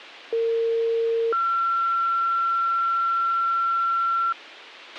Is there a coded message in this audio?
Yes: two-tone page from 0.3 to 4.3 s, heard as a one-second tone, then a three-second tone, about 460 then 1360 Hz, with a squelch burst at the end.